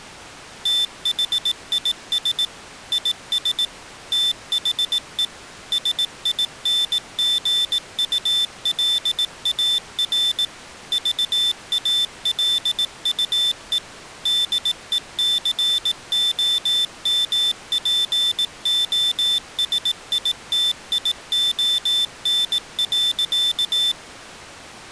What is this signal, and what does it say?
Morse code, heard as a high beeper, machine-sent, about 18 wpm, 3550 Hz. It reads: THIS IS THE SINGULAR VALUE DECOMPOSITION.